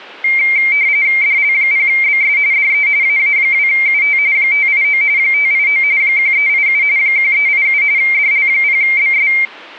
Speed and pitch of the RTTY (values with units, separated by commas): 45.45 baud, 170 Hz shift, 2200 Hz centre